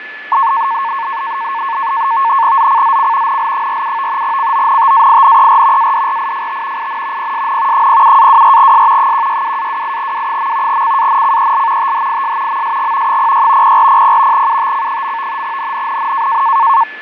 NAVTEX (SITOR-B), 100 baud, 170 Hz shift, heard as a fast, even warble, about 1000 Hz centre, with radio static, fading and a steady whistle near 1730 Hz. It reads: ZCZC NL47 CONTAINER ADRIFT IN PSN 07-24S 162-28W. CANCEL THIS MSG 06 0400 UTC. NNNN